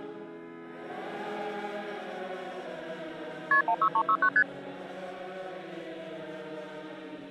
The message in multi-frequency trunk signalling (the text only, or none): KP 16369 ST